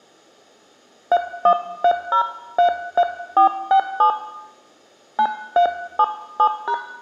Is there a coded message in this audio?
Yes: DTMF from 1.1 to 6.7 s, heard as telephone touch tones, dialled by hand, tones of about 80 ms, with room echo. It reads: 313033467 9377#